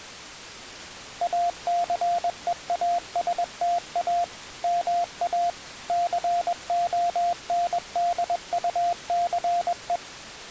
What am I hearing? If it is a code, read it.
Morse code, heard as a keyed tone, machine-sent, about 21 wpm, 700 Hz. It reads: ACEASTA MA CONDUCE